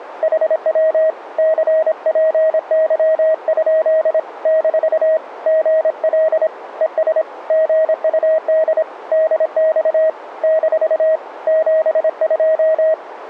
Morse code, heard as a keyed tone, hand-sent with a paddle, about 26 wpm, 640 Hz, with radio static. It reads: HW CPY? - GL ES GUD DX - 72